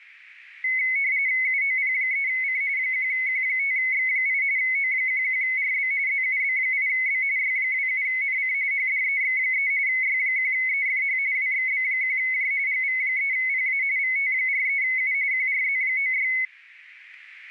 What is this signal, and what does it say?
RTTY (45.45 baud, 170 Hz shift), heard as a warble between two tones, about 2150 Hz centre, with radio static. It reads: UOP3C 1Q5X8 O11RB ZUB8B Y27NC HDEX3 Y1EFH WXB1J GV3PA VT43U QRZ96